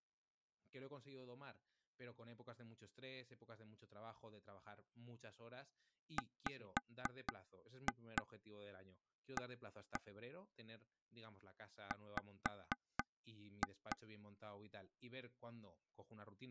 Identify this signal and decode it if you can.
Tap code, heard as taps on a table, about 4 knocks a second, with speech in Spanish. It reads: WA W